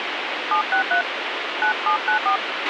DTMF, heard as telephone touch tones, dialled by hand, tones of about 100 ms, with radio hiss and a squelch burst at the end. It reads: 763 9794